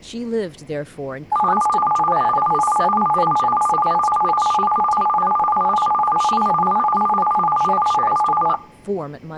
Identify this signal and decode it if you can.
A tone that alternates evenly between two pitches, with speech in English. There is no code.